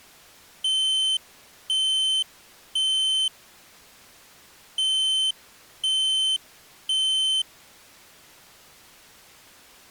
Alarm pattern, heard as an alarm's beeps, played twice, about 3100 Hz. Temporal three. Smoke or fire, evacuate.